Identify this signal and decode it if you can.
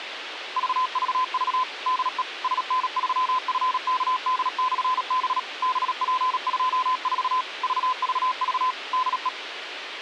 Morse code, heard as a keyed tone, machine-sent, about 37 wpm, 1020 Hz, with radio hiss. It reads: VVV DE SN3FKD/B BP24 VVV DE